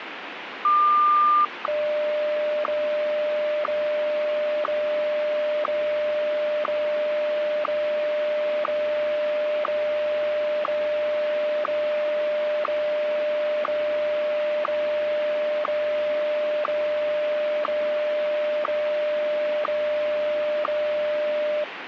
Radio time signal (WWVH, Hawaii), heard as ticks, one a second, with radio static.